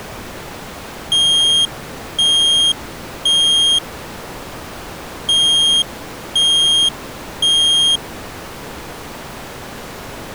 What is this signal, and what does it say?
Alarm pattern, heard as an alarm's beeps, played twice, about 3250 Hz. Temporal three. Smoke or fire, evacuate.